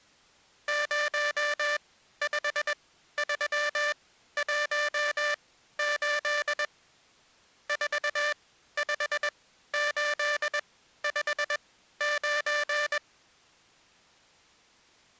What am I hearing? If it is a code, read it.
Morse code, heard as a buzzer, machine-sent, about 21 wpm, spaced as for 13 wpm. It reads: 05318 45859